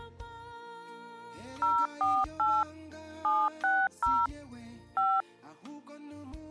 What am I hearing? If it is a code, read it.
DTMF, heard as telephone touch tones, dialled by machine, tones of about 230 ms. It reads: 048 760 5